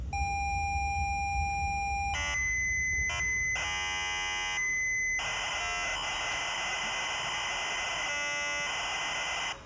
ZX Spectrum tape loading, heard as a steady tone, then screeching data, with room echo and the noise of a subway station.